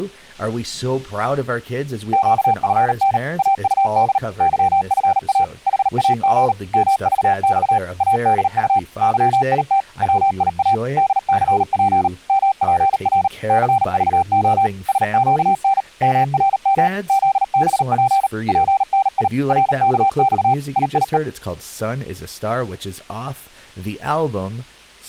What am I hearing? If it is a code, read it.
Morse code, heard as a keyed tone, machine-sent, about 38 wpm, 780 Hz, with speech in English. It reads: QFN AUD YFA HAG MVX ADU YIT WIA DCP MPR CVO SQN MRM ZBP PNI RKX IIE